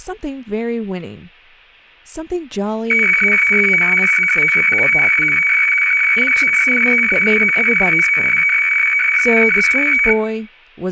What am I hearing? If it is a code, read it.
Weather fax (radiofax), 120 lines a minute, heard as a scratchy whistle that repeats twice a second, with room echo and speech in English.